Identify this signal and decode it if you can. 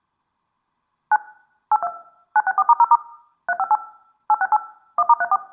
DTMF, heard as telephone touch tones, dialled by machine, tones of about 40 ms. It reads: 9 82 964*0* 358 868 1*34